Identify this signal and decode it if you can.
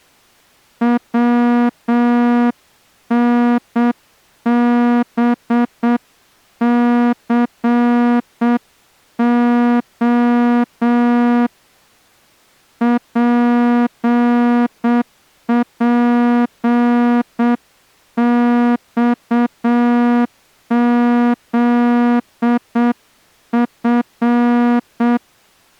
Morse code, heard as a horn, hand-sent with a straight key, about 7 wpm. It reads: WNBCO PPXZF